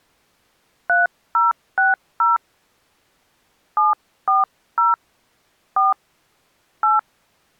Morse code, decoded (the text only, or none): none